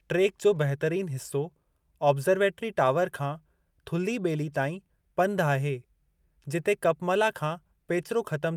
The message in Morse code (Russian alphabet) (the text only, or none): none